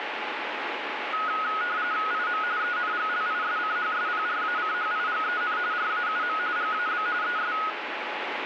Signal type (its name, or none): RTTY